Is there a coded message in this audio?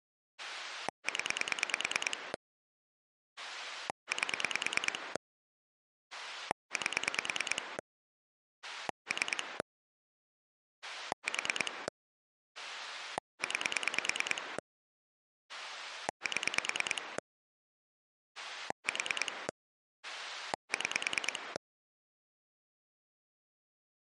Yes: pulse dialling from 0.4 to 21.6 s, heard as a rotary dial, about 9 pulses a second. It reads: 0 8 8 3 4 9 7 4 6